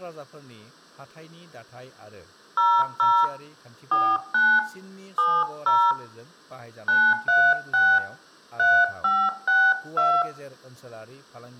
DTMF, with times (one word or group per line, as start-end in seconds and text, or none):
2.6-3.2 00
3.9-4.6 49
5.2-5.9 70
6.9-8.0 936
8.6-10.2 3562